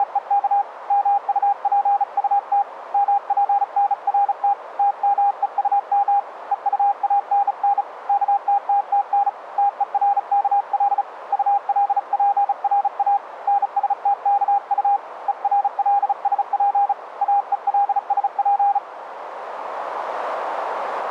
Morse code, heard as a keyed tone, hand-sent with a bug key, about 35 wpm, 810 Hz, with radio static. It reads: … MUPUT MPNRT TMEUM EUANN KTTTN TERKL ULPRA NSTKU ERLSP AELSP